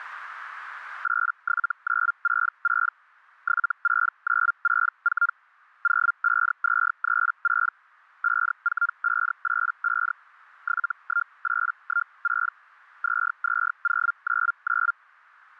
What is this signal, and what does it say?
Hellschreiber (Feld-Hell, 122.5 baud), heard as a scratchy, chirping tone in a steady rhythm, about 1400 Hz. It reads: 87966 76964 05236 54585 71816 22099